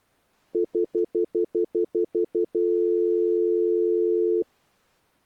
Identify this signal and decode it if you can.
Telephone call progress tone (North American plan), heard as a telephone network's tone, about 350, 440 Hz, 0.1 s on and 0.1 s off. Stutter dial tone.